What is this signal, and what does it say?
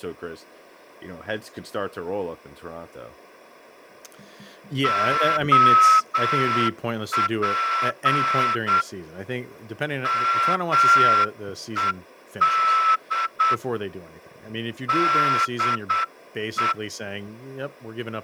Morse code, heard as a whistle, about 8 wpm, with speech in English. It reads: OP MED DE